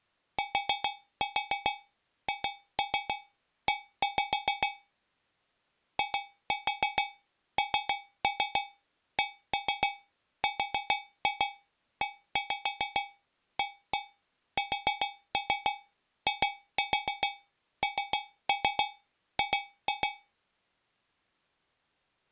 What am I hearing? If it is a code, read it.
Tap code, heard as taps on a metal pipe, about 7 knocks a second. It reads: THE INCREASING